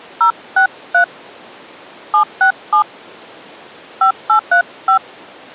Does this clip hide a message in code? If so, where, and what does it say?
Yes: DTMF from 0.2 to 5.0 s, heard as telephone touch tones, dialled by hand, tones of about 100 ms. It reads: 063 767 5835